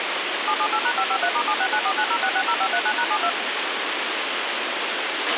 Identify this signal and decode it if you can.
DTMF, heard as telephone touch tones, dialled by machine, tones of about 70 ms, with radio hiss and a squelch burst at the end. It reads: 778#553*769490660539#72